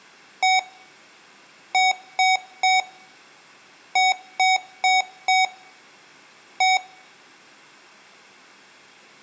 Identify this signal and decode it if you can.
Beep code, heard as beeps from a small speaker, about 750 Hz, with room echo. 1-3-4-1. In Phoenix BIOS tables: memory failure on an address line.